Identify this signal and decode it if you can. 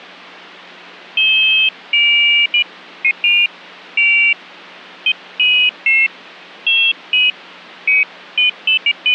Pairs of high tones at irregular times. There is no code.